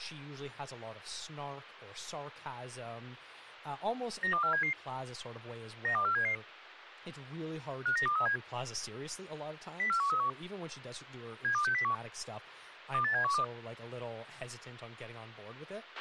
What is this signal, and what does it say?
Five-tone selective call (CCIR), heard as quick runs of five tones, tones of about 100 ms, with a squelch burst at the end and speech in English. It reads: 92477 92477 59237 04131 72601 28712